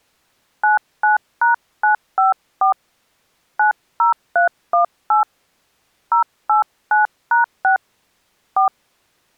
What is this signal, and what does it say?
DTMF, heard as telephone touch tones, dialled by hand, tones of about 130 ms. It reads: 99#954 90318 089#6 4